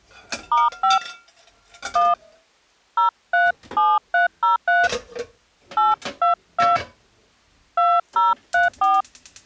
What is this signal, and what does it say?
DTMF, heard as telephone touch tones, dialled by hand, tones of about 180 ms, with kitchen noise. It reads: *5 1 037303 822 2034